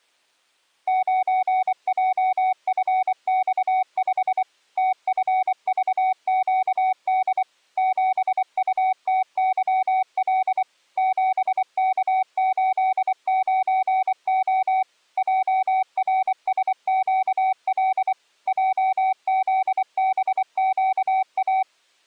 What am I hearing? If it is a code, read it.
Morse code, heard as a keyed tone, machine-sent, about 24 wpm, 750 Hz. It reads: 9JFX5 TFVQD 7UTYL 7K89O JRSQL JZBQA